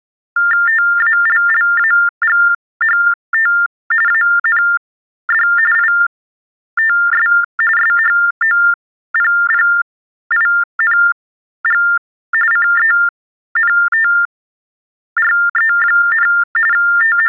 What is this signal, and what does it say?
TTY/TDD text telephone tones (45.45 baud Baudot), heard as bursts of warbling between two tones, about 400 Hz shift, 1600 Hz centre. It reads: TALLAGHT AND ITS SHOPPING CENTRE, …